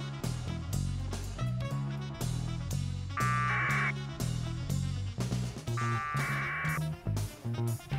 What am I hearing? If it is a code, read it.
Packet radio (AX.25, as in APRS), 1200 baud, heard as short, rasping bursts, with a squelch burst at the end.